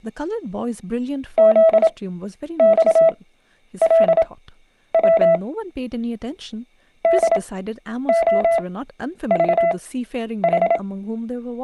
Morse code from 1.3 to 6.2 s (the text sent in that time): ZXLW